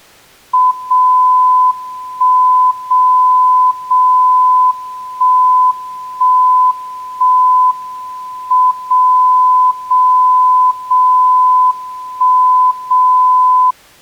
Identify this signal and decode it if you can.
Radio time signal (WWVB), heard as a tone whose level steps once a second, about 1010 Hz. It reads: 0 1 0 0 1 1 1 M 0 0 0 1 0